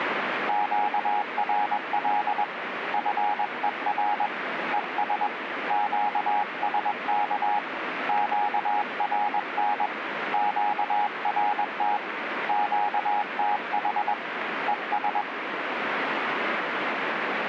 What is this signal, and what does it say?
Morse code, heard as a keyed tone, hand-sent with a paddle, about 21 wpm, 830 Hz, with radio static. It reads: QRL FER ES QSK QRN QRT QTH ES